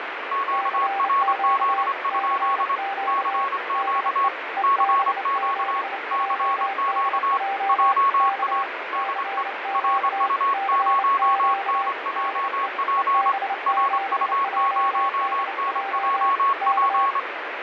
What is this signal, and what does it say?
Morse code, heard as two keyed tones, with radio static. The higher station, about 25 wpm, 1100 Hz: QRZ? CQ CQ CQ JA DE RU0NJP RU0NJP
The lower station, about 28 wpm, 790 Hz: CQ CQ DE EB7JDJ K CQ CQ DE EB7JDJ K